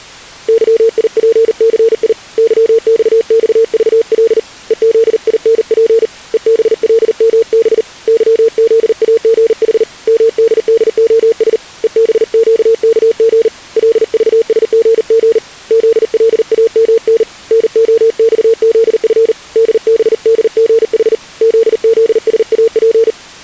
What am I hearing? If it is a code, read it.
Morse code, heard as a keyed tone, hand-sent with a paddle, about 39 wpm, 460 Hz. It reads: YIPCI YXXVL EZINP EBLMB YZAGH MDDOS EBQKG LVSGG ZLAMN NOXZF DBDGH ZZSAP